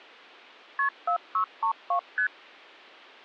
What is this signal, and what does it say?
Multi-frequency trunk signalling (R1, as on North American trunks), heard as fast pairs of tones, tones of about 90 ms. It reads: KP 4632 ST